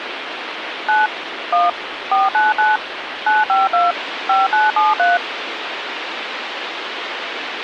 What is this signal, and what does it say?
DTMF, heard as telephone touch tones, dialled by machine, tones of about 170 ms, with phone line noise. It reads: 9 1 499 952 5973